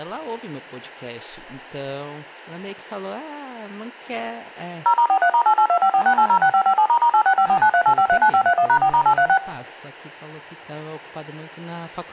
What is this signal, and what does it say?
DTMF, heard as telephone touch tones, dialled by machine, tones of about 80 ms, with speech in Portuguese. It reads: 0*43*882546806557**8654938539531#4*836